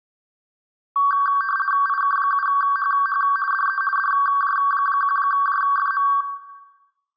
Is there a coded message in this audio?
Yes: RTTY (50 baud, 450 Hz shift) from 1.0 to 6.2 s, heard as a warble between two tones, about 1350 Hz centre, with room echo. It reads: IK7HH DE DJ1JFM